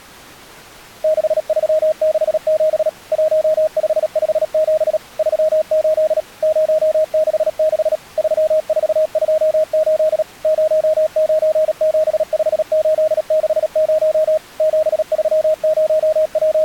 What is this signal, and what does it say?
Morse code, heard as a keyed tone, machine-sent, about 37 wpm, 620 Hz. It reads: 6367 1557 38 066 3428 0975860 …